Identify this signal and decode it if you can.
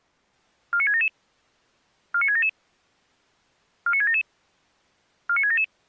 Five-tone selective call (ZVEI), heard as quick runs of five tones, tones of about 70 ms. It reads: 49677 49677 49677 49677